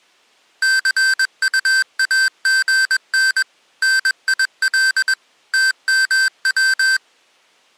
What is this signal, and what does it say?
Morse code, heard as electronic beeps, machine-sent, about 21 wpm, 1550 Hz. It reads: CUAGN NIL TMW